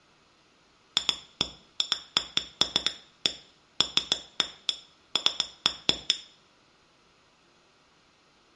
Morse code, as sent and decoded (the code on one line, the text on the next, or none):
none